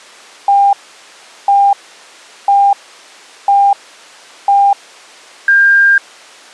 Radio time signal (five pips and a higher one, as on Chinese radio), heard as pips.